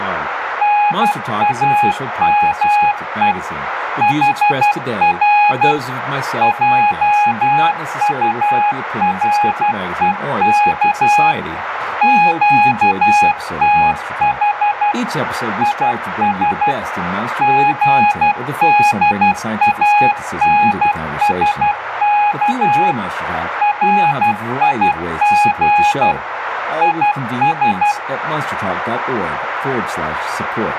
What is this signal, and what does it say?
Morse code, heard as a keyed tone, machine-sent, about 12 wpm, 830 Hz, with radio static, a narrow filter, room echo and speech in English. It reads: NAME HR JUREK QTH IS GDANSK RIG IS